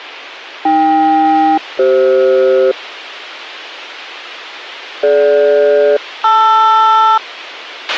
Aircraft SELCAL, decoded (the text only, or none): AK-CF DG-LR